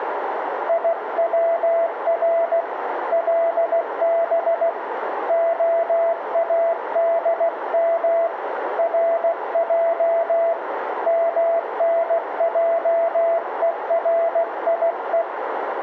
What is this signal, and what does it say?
Morse code (Hebrew alphabet), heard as a keyed tone, hand-sent with a paddle, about 16 wpm, 670 Hz, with radio static, a narrow filter and room echo. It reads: יצר לב האדם רע מנעוריו